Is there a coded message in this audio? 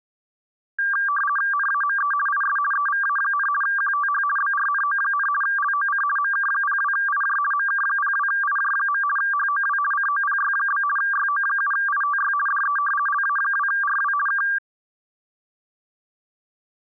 Yes: RTTY (50 baud, 450 Hz shift) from 0.8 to 14.6 s, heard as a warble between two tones, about 1380 Hz centre. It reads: NAME IS EVA, QTH BRNO, LOC MK02IJ MK02IJ. HOW COPY? YO7ITY DE LA2RW K